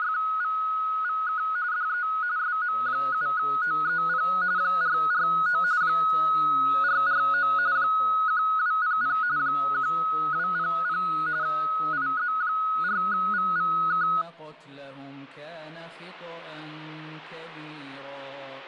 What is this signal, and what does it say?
RTTY (45.45 baud, 170 Hz shift), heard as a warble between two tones, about 1360 Hz centre. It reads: … DE SM7OEP 449 449 1200 1200 IZ4VVK